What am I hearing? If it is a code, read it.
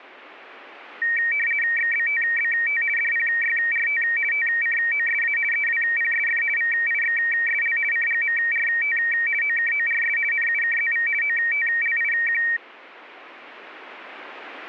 RTTY (50 baud, 450 Hz shift), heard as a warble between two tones, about 2100 Hz centre. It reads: XBTBT DPYRT TCOSA EWPSF VIXSL CGMRT OKORS NUKZV OTLIQ